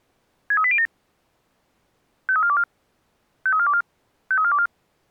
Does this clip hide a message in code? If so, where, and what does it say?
Yes: five-tone selective call (ZVEI) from 0.5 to 4.7 s, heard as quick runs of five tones, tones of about 70 ms. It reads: 63807 53424 53424 53424